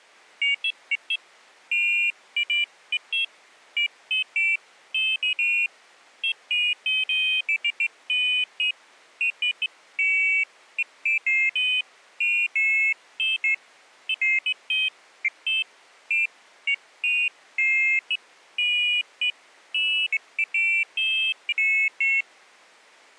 Pairs of high tones at irregular times. There is no code.